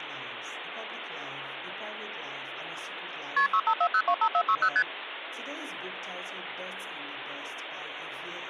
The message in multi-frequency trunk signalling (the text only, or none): KP 654025460 ST